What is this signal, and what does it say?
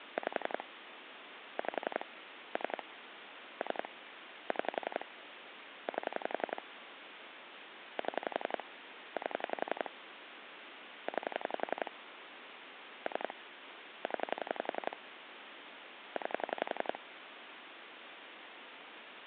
Pulse dialling, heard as clicks on a phone line, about 11 pulses a second, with phone line noise. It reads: 5 5 3 3 6 8 7 8 9 3 0 9